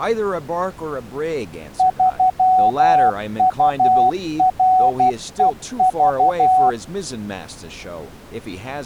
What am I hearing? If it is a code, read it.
Morse code, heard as a keyed tone, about 12 wpm, 750 Hz, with speech in English. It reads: 3UREV